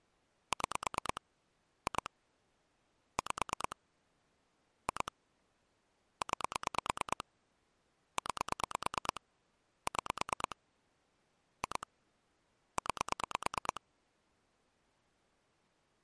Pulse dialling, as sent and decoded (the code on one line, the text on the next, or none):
6 / 2 / 5 / 2 / 9 / 9 / 6 / 2 / 9
6 2 5 2 9 9 6 2 9